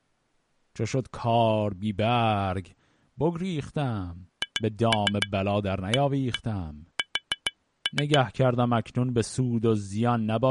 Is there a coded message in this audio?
Yes: tap code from 4.4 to 8.2 s, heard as taps on glass, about 7 knocks a second, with speech in Persian. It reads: HAS